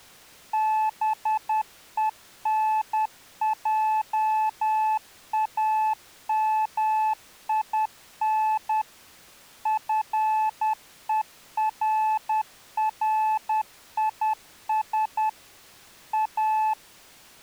Morse code, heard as a keyed tone, machine-sent, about 10 wpm, 870 Hz. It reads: BENJAMIN FERRIS A